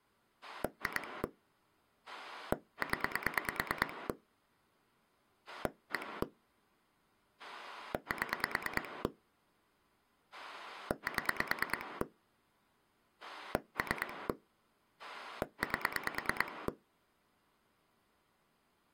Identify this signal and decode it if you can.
Pulse dialling, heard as a rotary dial, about 9 pulses a second. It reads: 2 0 1 7 7 3 8